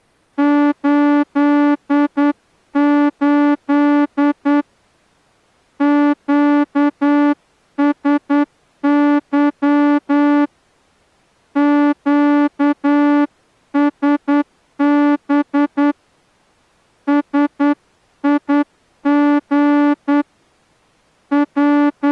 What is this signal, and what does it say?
Morse code, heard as a horn, hand-sent with a straight key, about 9 wpm. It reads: 88 QSY QSB SIG …